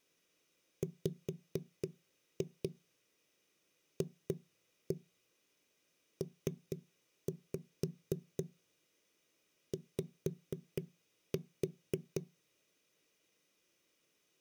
Tap code, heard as knocks on a wall, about 4 knocks a second. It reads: WFPY